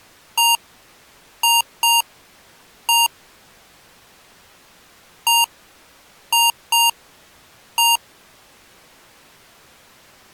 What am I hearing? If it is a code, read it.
Beep code, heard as beeps from a small speaker, played twice, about 930 Hz. 1-2-1. In Phoenix BIOS tables: interval timer failure.